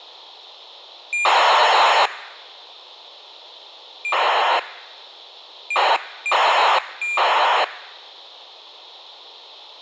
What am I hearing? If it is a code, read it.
ACARS aircraft data, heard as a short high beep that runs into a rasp, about 2400 baud, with a squelch burst at the end.